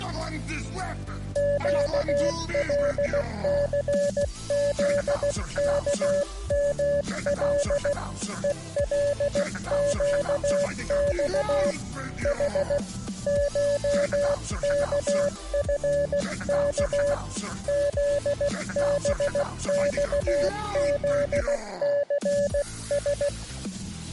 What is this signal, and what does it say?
Morse code (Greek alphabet), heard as a keyed tone, hand-sent with a paddle, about 16 wpm, 570 Hz. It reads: ΨΛΘΖΚΜΛ ΕΛΨΞ Η ΧΚΦΚ ΖΒΞΖΘΣ